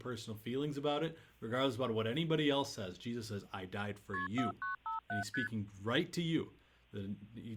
Multi-frequency trunk signalling (R1, as on North American trunks), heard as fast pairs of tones, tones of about 130 ms, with speech in English. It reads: KP 4957 ST